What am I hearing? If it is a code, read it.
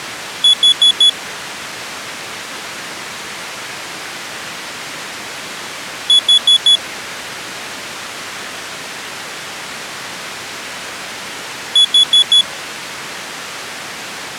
Alarm pattern, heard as an alarm's beeps, played three times, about 3400 Hz. Temporal four. Carbon monoxide.